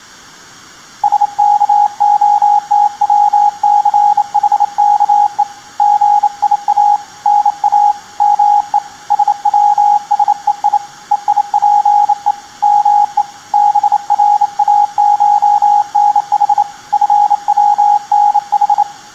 Morse code (Greek alphabet), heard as a keyed tone, hand-sent with a bug key, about 28 wpm, 830 Hz, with room echo. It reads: ΣΚΟΤΩΘΗΚΕ ΓΙΑ ΝΑ ΜΕ ΣΩΣΕΙ ΕΙΠΕ ΜΕ ΒΡΑΧΝΗ ΦΩΝΗ